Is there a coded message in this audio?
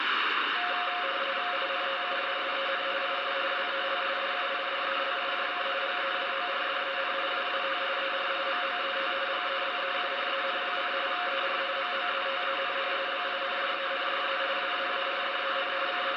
Yes: RTTY (45.45 baud, 170 Hz shift) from 0.6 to 16.2 s, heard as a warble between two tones, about 630 Hz centre, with radio static. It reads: INTUSSEN IS WEL DUIDELIJK GEWORDEN WAT ER MOET GEBEUREN: ER MOETEN BINDENDE WAARDEN …